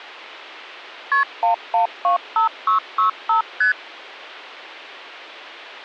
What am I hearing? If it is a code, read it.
Multi-frequency trunk signalling (R1, as on North American trunks), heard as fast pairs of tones, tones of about 120 ms. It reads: KP 1125665 ST